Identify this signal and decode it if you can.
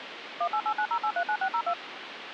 DTMF, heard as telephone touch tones, dialled by machine, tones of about 70 ms, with phone line noise. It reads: 18890839602